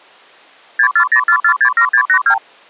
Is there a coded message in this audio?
Yes: multi-frequency trunk signalling (R2, with the far end's replies) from 0.8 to 2.4 s, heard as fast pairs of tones, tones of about 80 ms. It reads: 6404467682